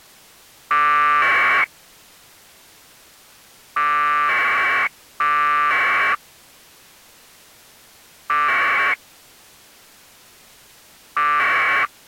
Packet radio (AX.25, as in APRS), 1200 baud, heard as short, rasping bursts.